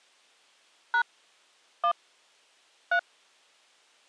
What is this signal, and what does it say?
DTMF, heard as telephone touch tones, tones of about 80 ms. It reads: # 1 3